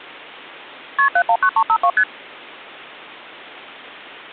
Multi-frequency trunk signalling (R1, as on North American trunks), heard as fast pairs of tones, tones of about 70 ms. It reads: KP 719352 ST